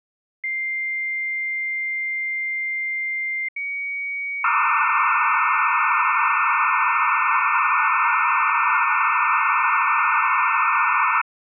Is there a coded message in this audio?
Yes: dial-up modem handshake (low-speed, two carriers) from 0.4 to 11.2 s, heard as two whistles, then hiss.